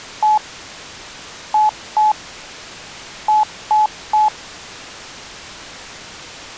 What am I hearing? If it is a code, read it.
Beep code, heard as beeps, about 860 Hz. 1-2-3. In Phoenix BIOS tables: DMA page register failure.